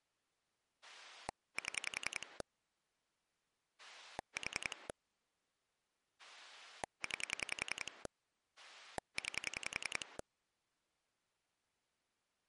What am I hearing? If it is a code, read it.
Pulse dialling, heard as a rotary dial, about 10 pulses a second. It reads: 7 4 9 9